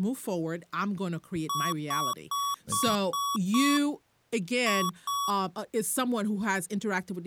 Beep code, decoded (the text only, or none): 6-2